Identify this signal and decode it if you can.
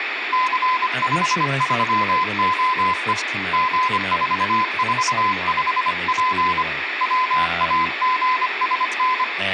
Morse code, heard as a keyed tone, hand-sent with a paddle, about 25 wpm, 1020 Hz, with radio static, room echo and speech in English. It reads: C53OE G445P WAGSN